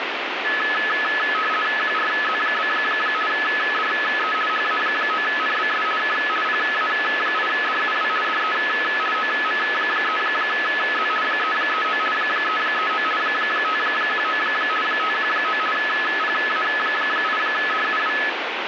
RTTY (50 baud, 450 Hz shift), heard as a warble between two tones, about 1500 Hz centre, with radio static. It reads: QRZ? DE HA9NBS K PA8DUW DE OM3Z 339 339 519 519 PA8DUW